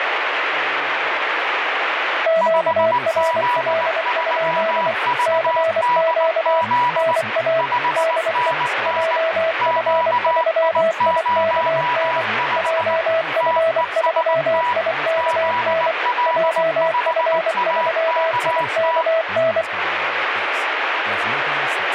Morse code, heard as two keyed tones, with radio static and speech in English. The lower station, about 24 wpm, 650 Hz: QRL? CQ NA DE JF3IKN JF3IKN JF3IKN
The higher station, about 19 wpm, 980 Hz: 5Z3VDZ 5NN QI05 TEST ZL5AKT